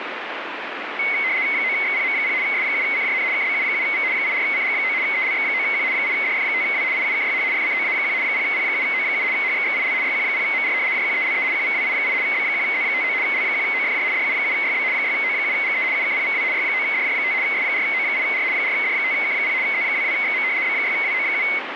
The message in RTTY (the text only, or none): 9XPM0 S7CJN KBU7V 84CG9 ELX9Q 8DF5W IUKYH FCOA1 0P7O7 HXXIL YQ0MR JQELE QVWI8 B1Z59 L1OFJ DU7YB 6O7GE UKPVW Y9DJ5 S4O8R 4D5K0 Z22XM B6WO7